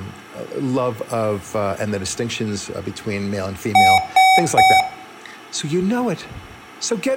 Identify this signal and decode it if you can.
Beep code, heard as beeps from a small speaker, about 760 Hz, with room echo and speech in English. 3 short. In AMI BIOS tables: failure in the first 64 KB of memory; in Dell tables: chipset error.